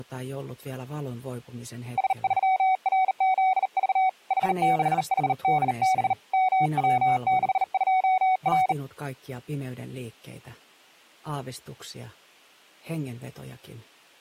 Morse code, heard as a keyed tone, hand-sent with a bug key, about 39 wpm, 750 Hz. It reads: S3RZV H6HDB MW62R